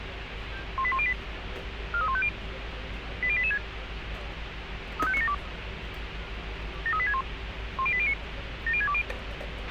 Five-tone selective call (ZVEI), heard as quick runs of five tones, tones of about 70 ms, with radio hiss, a squelch burst at the end and street noise. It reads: 18108 43150 80886 35972 73861 10809 70620